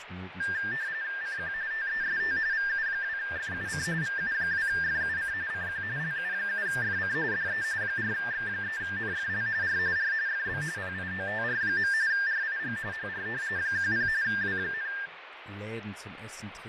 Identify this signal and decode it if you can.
RTTY (45.45 baud, 170 Hz shift), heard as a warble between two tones, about 1700 Hz centre, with radio static, fading and speech in German. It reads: CQ TEST VU2FUC VU2FUC CQ LU7FC DE 4X3NFL R R FB PIOTR. RIG HR 10 W,